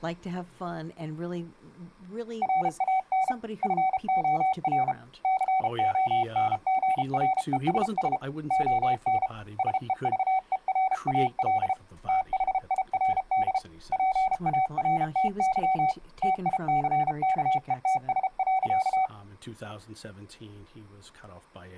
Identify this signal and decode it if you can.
Morse code, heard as a keyed tone, hand-sent with a paddle, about 33 wpm, 760 Hz. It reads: RAN FOR CONGRESS ON SEVERAL THIRD PARTY TICKETS.